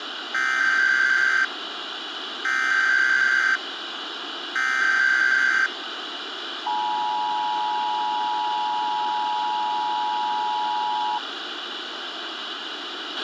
Emergency Alert System (SAME) tones (header bursts, then the 853 and 960 Hz attention tone), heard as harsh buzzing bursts, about 520.83 baud, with radio hiss and a squelch burst at the end.